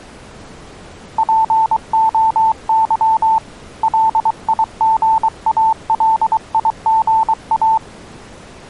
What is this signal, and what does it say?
Morse code (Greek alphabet), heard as a keyed tone, hand-sent with a paddle, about 23 wpm, 890 Hz. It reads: ΠΟΥ ΛΙΓΑΛΙΓΑ